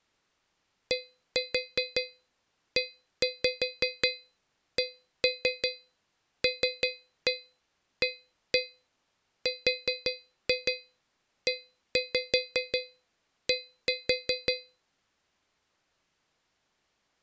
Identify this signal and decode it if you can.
Tap code, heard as taps on a metal pipe, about 5 knocks a second. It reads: DECLARED